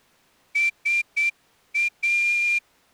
Morse code, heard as a whistle, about 8 wpm. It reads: SA